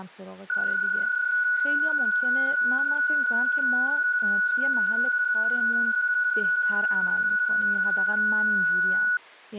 PSK31 (31.25 baud), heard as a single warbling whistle, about 1470 Hz, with speech in Persian.